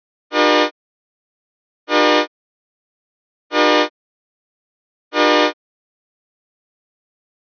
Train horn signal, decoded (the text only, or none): 4 short